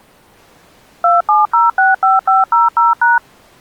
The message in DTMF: 27065500#

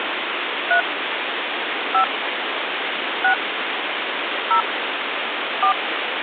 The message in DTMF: 3 5 6 0 4

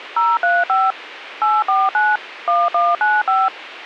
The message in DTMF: 035 849 1195

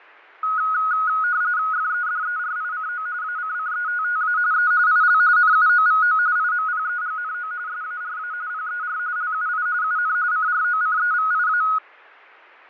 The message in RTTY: FEDERICO ACCETTA E IL NUOVO IMPEGNO SARA PER LUI UN CROCEVIA

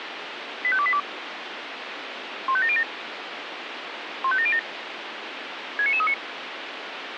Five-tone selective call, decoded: 85282 15707 15707 69939

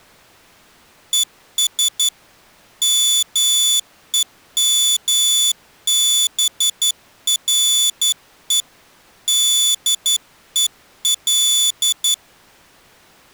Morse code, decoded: ES MEMBRE DEL

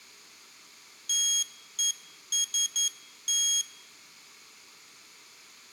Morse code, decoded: TEST

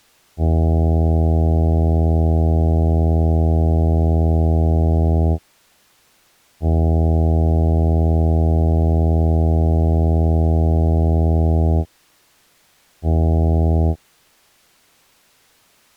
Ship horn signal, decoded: 2 long, 1 short

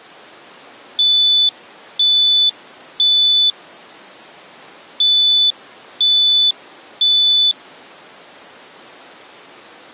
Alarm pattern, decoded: temporal three

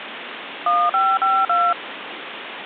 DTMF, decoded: 1552

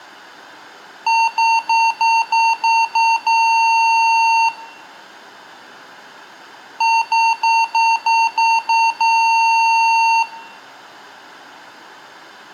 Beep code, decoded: 7 short, 1 long

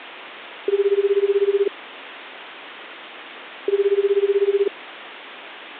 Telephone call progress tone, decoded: ringback tone

